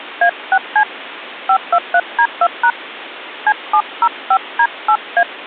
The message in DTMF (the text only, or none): A6C 523D2# C705D8A